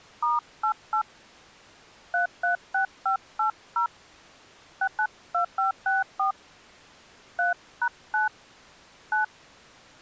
DTMF, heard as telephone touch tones, dialled by hand, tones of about 120 ms. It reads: *88 336580 692564 3#9 9